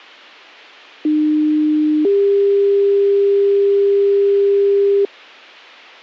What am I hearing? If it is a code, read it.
Two-tone page, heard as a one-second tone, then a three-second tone, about 300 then 400 Hz.